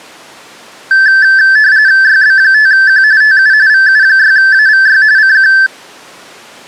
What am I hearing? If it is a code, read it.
RTTY (45.45 baud, 170 Hz shift), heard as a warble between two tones, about 1650 Hz centre. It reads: YB5Q TU VU6AVY CQ